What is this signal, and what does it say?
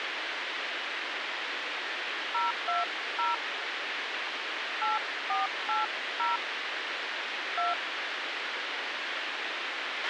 DTMF, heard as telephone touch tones, dialled by hand, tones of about 160 ms, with radio hiss and a squelch burst at the end. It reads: 020 8480 2